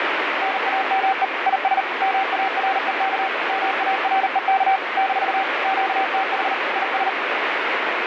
Morse code, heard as a keyed tone, machine-sent, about 39 wpm, 770 Hz, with heavy radio static. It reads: NAME IS MAREK MAREK - QTH IS